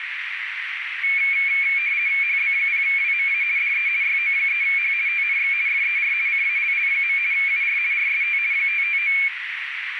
RTTY (50 baud, 170 Hz shift), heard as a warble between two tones, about 2300 Hz centre, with radio static and a narrow filter. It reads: HB0WMA DE YO3H TNX FER CALL. UR RST 559